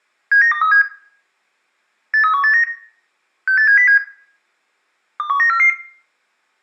Five-tone selective call (CCIR), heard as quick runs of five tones, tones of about 100 ms, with room echo. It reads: 79237 83189 68707 21944